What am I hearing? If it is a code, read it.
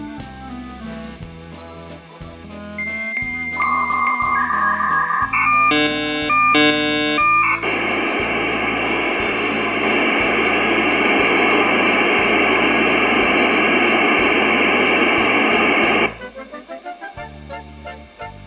Dial-up modem handshake (V.34 or later), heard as a whistle, warbles, then hiss, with room echo.